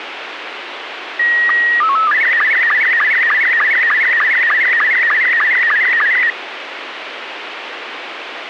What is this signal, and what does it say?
SSTV (slow-scan television), Robot 72, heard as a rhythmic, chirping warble, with radio hiss.